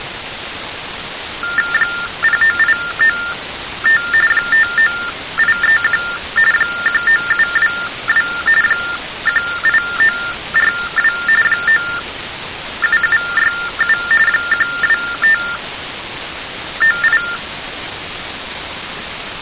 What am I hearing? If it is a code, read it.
TTY/TDD text telephone tones (45.45 baud Baudot), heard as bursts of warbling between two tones, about 400 Hz shift, 1600 Hz centre. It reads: 09895 59831 19722 18942 97767 12598